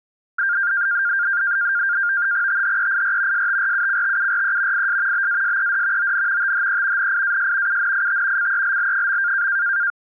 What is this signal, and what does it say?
NAVTEX (SITOR-B), 100 baud, 170 Hz shift, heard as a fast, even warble, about 1500 Hz centre. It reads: THEIR STRUCTURE IS BASED ON THE NIAS UNIT CELL.